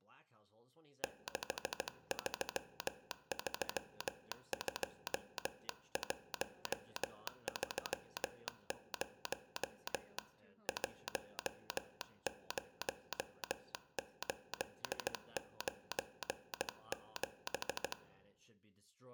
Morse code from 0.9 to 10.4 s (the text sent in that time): 6332130